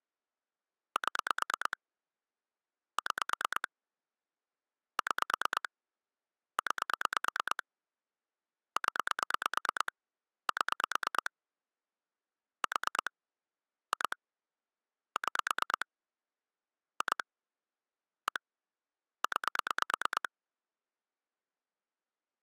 Pulse dialling, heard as clicks on a phone line, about 9 pulses a second. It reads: 7 6 6 9 0 7 4 2 6 2 1 9